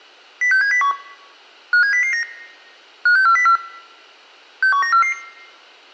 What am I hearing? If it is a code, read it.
Five-tone selective call (CCIR), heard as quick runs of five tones, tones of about 100 ms. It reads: 06701 57009 56404 61944